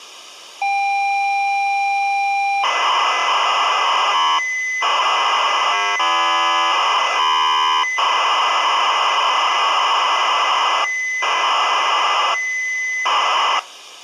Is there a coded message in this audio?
Yes: ZX Spectrum tape loading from 0.6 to 13.6 s, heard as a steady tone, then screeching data.